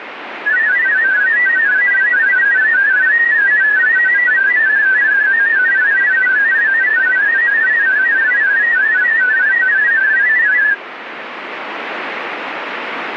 Multi-tone FSK (Olivia or MFSK type), about 500 Hz wide, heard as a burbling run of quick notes, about 31.25 baud, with radio static.